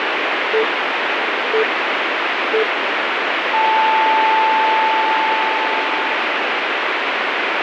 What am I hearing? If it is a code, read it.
Radio time signal (three low pips and a long one an octave up, as on NHK), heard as pips, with radio static.